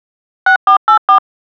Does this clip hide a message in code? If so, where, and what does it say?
Yes: DTMF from 0.5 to 1.2 s, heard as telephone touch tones, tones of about 100 ms. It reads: 6484